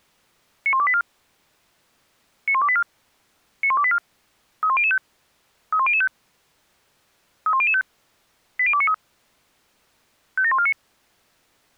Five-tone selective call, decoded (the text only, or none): 91284 91284 91284 31005 31005 31005 80293 57149